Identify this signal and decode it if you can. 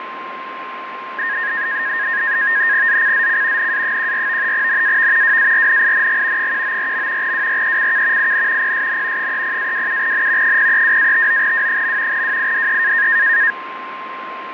NAVTEX (SITOR-B), 100 baud, 170 Hz shift, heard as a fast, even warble, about 1750 Hz centre, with radio static and a steady whistle near 1050 Hz. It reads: ZCZC NA14 NAV WARNING 194. WRECK IN PSN 30-27N 032-59W. WIDE